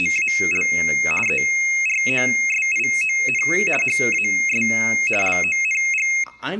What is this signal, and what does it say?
RTTY (50 baud, 450 Hz shift), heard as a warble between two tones, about 2350 Hz centre, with speech in English. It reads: … EROSION HAS LONG